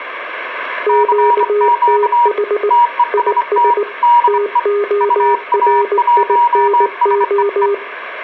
Morse code, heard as two keyed tones, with room echo. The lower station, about 19 wpm, 410 Hz: QTH IS TORINO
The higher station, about 25 wpm, 960 Hz: CQ TEST DE UA1SEE